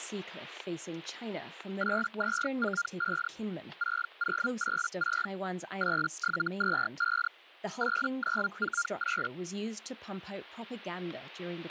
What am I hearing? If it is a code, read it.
Hellschreiber (Feld-Hell, 122.5 baud), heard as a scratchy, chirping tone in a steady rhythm, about 1400 Hz, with static crashes and speech in English. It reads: 8245 6086 8725 8948